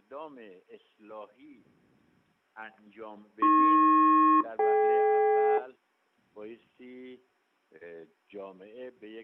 Aircraft SELCAL, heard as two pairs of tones. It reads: AP-DK